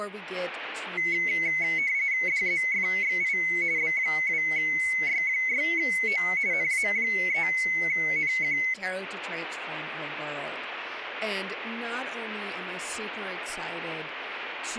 RTTY (45.45 baud, 170 Hz shift), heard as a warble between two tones, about 2150 Hz centre. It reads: DZFXI B2Y6O NA3NQ